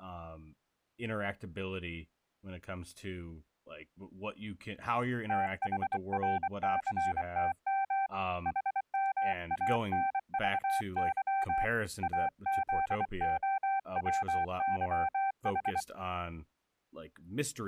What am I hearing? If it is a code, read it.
Morse code, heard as a keyed tone, hand-sent with a bug key, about 24 wpm, 780 Hz, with speech in English. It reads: THRCTM HMANVY AZOWYH